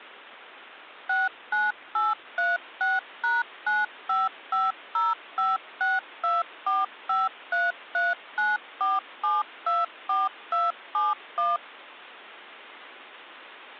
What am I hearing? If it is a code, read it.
DTMF, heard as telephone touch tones, dialled by machine, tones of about 180 ms. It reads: 69836#9550562453394724271